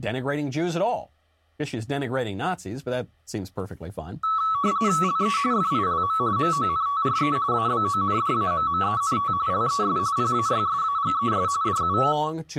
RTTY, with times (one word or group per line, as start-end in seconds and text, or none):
5.0-5.4 LE
5.5-6.2 FILM
6.4-7.4 MONTRE
7.5-9.3 ABONDAMMENT
9.5-10.0 LES
10.2-11.5 PAYSAGES
11.6-12.0 DU